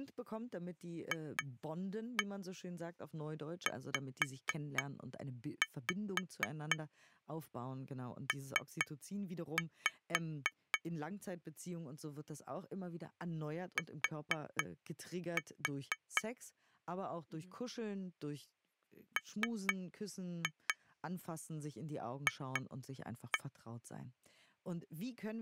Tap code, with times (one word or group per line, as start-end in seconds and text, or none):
1.1-10.8 FZP
13.8-16.2 T
19.2-23.4 MF